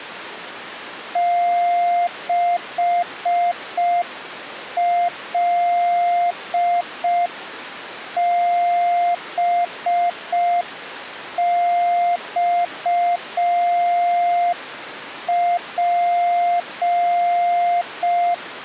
Morse code, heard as a keyed tone, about 5 wpm, 700 Hz. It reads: 6LBXP